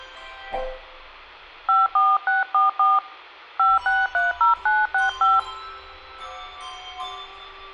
DTMF, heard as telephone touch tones, dialled by hand, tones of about 170 ms, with hum. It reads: 54644 5630965